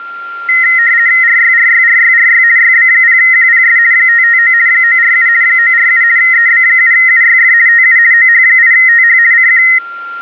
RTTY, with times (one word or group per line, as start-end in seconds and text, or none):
1.2-2.4 RYRYRYRY
2.6-3.8 YB0QPS
3.9-4.5 559
4.7-5.3 947
5.4-6.0 947
6.2-7.5 EB7UYF
7.7-8.0 TU
8.1-9.2 OH8TH
9.3-9.6 CQ